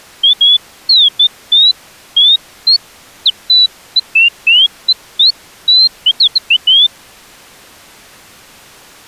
Bird-like chirps. There is no code.